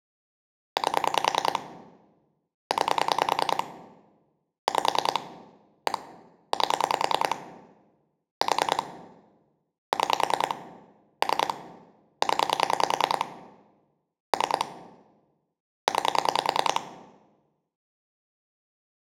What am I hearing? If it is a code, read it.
Pulse dialling, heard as clicks on a phone line, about 10 pulses a second, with room echo. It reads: 8 9 5 1 8 4 6 3 0 3 9